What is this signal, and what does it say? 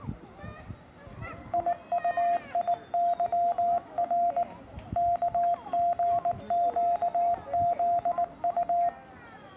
Morse code, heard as a keyed tone, hand-sent with a paddle, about 19 wpm, 700 Hz, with the noise of a residential street. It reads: IUIYR KGQZU